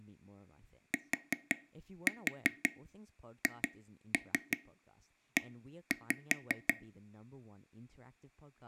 Tap code, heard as taps on a table, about 5 knocks a second, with speech in English. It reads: THE